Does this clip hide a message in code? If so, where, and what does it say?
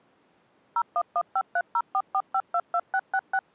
Yes: DTMF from 0.8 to 3.4 s, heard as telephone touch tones, dialled by machine, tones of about 60 ms. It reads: 01153044522666